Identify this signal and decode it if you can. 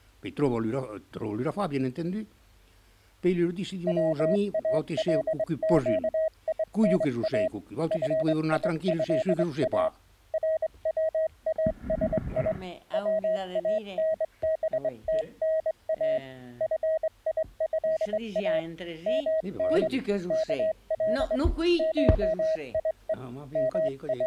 Morse code (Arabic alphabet), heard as a keyed tone, hand-sent with a straight key, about 23 wpm, 640 Hz. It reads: والقينا فيها رواسي وانبتنا فيها من كل شيء …